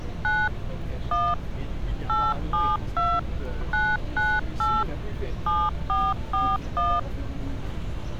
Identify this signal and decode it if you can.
DTMF, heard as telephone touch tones, dialled by machine, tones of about 230 ms, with street noise. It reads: 9 1 872 998 7441